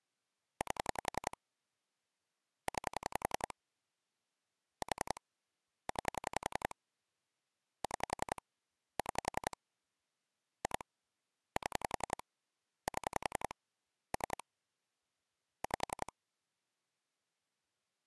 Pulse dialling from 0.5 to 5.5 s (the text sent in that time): 8 9 4